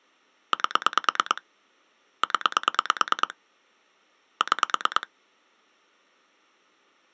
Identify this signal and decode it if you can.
Pulse dialling, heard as clicks on a phone line, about 9 pulses a second. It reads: 8 0 6